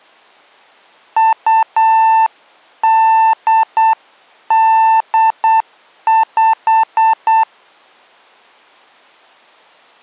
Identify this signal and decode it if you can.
Morse code (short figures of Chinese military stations), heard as a keyed tone, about 8 wpm, 890 Hz. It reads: 2885